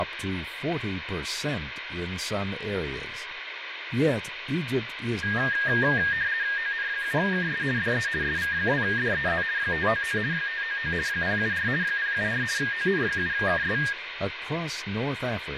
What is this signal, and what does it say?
RTTY (50 baud, 170 Hz shift), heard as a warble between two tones, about 1750 Hz centre, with radio static. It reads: ON7KS DE SV2DEZ 599 599 074 074 ON7KS